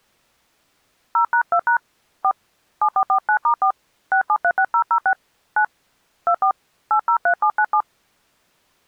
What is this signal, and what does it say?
DTMF, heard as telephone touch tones, dialled by hand, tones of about 80 ms. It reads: 0#2# 4 7449*4 6736006 9 24 803797